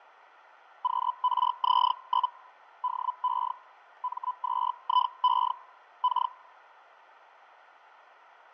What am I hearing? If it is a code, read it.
Hellschreiber (Feld-Hell, 122.5 baud), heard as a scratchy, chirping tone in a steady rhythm, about 1000 Hz, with radio static and fading. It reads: QRZ? DE M2IE K